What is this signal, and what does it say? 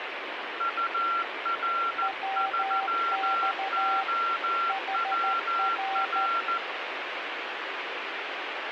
Morse code, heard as two keyed tones, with radio static. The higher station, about 14 wpm, 1360 Hz: UR3OWR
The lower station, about 13 wpm, 780 Hz: WX HR